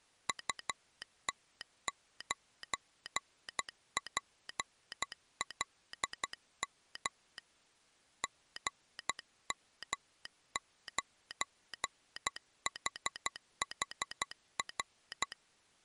Morse code, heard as a telegraph sounder, hand-sent with a paddle, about 12 wpm. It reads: UT9PLM GM9HHR